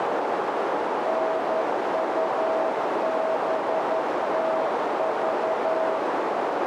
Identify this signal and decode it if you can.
Morse code, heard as a keyed tone, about 11 wpm, 640 Hz, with heavy radio static and a narrow filter. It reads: NUBTV